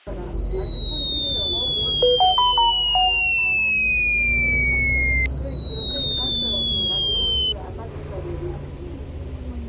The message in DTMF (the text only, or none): none